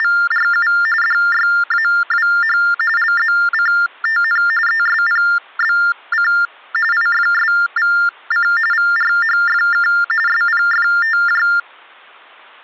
TTY/TDD text telephone tones (45.45 baud Baudot), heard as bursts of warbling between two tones, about 400 Hz shift, 1600 Hz centre. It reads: … DYAWH LZCTN ESPBC IFSVC VRHFK SPFTJ